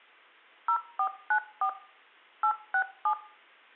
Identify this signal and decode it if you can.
DTMF, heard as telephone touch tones, dialled by machine, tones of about 80 ms, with room echo. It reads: 0494 867